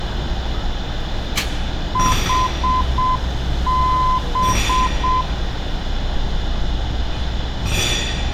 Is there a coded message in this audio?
Yes: Morse code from 1.9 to 5.3 s, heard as a keyed tone, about 7 wpm, 1020 Hz, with street noise. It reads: HB